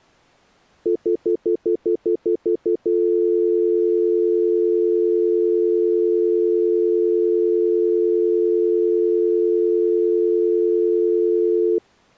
Telephone call progress tone (North American plan), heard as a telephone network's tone, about 350, 440 Hz, 0.1 s on and 0.1 s off. Stutter dial tone.